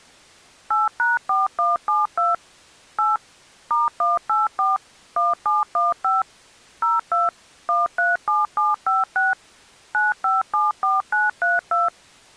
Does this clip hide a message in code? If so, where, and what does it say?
Yes: DTMF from 0.7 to 11.9 s, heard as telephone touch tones, dialled by machine, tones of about 170 ms. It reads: 8#4172 8 *184 1715 02 137756 9574932